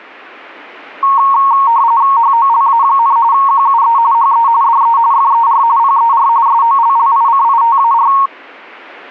RTTY (45.45 baud, 170 Hz shift), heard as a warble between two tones, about 1010 Hz centre. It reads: HOLA, QUE HE DE FER PER SOLLICITAR